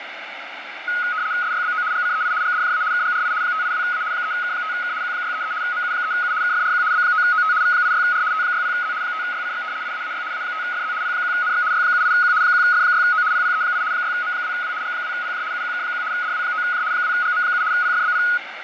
RTTY (75 baud, 170 Hz shift), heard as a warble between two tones, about 1360 Hz centre, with radio static and fading. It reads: SYBO GCEI GDJA KGRI 582A 3K5K Q633 MU3U KFRQ B9OT V86R T60Z 5YCX IAAY A5FZ P1NX Y78Q 1F6O PPE8 6M2W G2PJ UQK1 DW9J 2GM7 PFBP